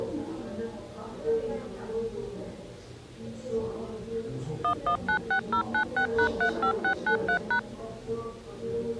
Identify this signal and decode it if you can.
DTMF, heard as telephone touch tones, dialled by machine, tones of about 90 ms, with the noise of a crowd indoors. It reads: 1196096#35693#